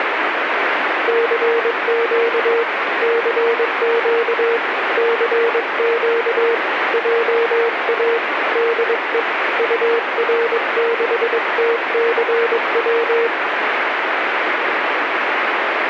Morse code, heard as a keyed tone, hand-sent with a paddle, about 22 wpm, 460 Hz, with radio static. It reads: CQ CQ CQ JA DE UR6TCW